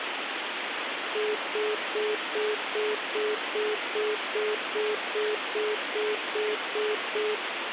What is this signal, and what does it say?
Telephone call progress tone (single-tone plan, as in most of Europe), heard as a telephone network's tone, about 420 Hz, 0.2 s on and 0.2 s off, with phone line noise. Congestion tone.